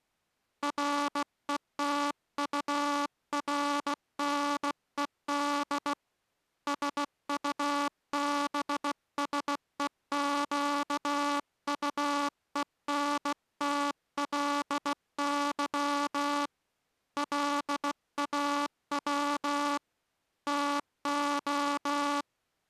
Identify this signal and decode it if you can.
Morse code, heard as a buzzer, hand-sent with a bug key, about 16 wpm. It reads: RETURNED SUBSEQUENTLY LAW TO